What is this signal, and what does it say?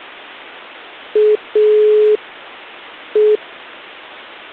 Telephone call progress tone (pulsed, as in Italy), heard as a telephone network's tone, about 420 Hz. Dial tone.